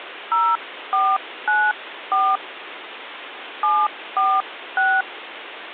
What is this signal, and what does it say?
DTMF, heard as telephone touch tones, dialled by hand, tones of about 240 ms, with phone line noise. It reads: 0494 746